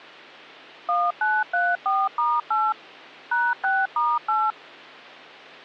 DTMF, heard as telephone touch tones, dialled by machine, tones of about 220 ms. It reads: 1934*8 #6*8